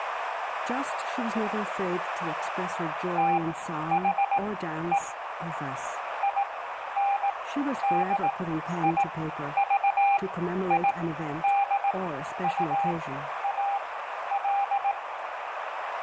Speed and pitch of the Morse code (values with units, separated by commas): 18 wpm, spaced as for 11 wpm, 800 Hz